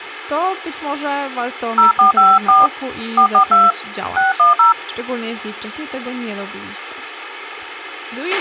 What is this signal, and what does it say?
DTMF, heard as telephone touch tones, dialled by hand, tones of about 150 ms, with radio hiss, a squelch burst at the end and speech in Polish. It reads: 0454 442 610